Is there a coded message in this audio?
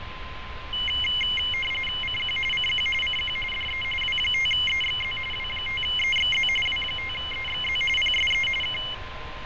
Yes: RTTY (45.45 baud, 850 Hz shift) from 0.7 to 8.9 s, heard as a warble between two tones, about 2550 Hz centre, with radio static, fading, a steady whistle near 1030 Hz and street noise. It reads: CQ CQ CQ DE W5EXZ W5EXZ W5EXZ PSE K